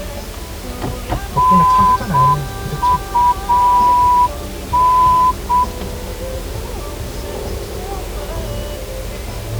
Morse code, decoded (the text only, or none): NUN